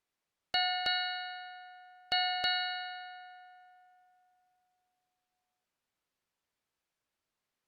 Ship's bell, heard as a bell. 4. Four half-hours of the watch have passed.